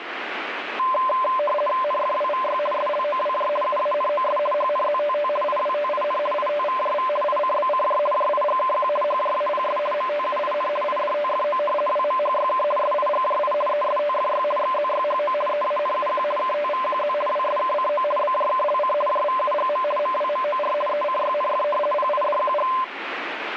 RTTY (50 baud, 450 Hz shift), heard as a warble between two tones, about 810 Hz centre, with radio static. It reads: NFWVY SLOWJ UANOS HNZTT IWTIN ITVJV ICBCJ JIGKQ HJAPS MTUIN IDTFO WMHYK SIGJI ESTFY XZYHO EANUQ KTVQZ WSKCO BJKLC JVUGM MWMOR ECYNF PIDQG